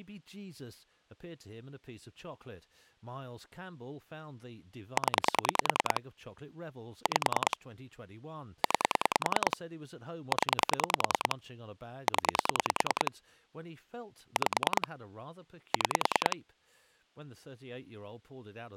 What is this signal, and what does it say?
Pulse dialling, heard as clicks on a phone line, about 10 pulses a second, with speech in English. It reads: 0 5 9 0 0 5 6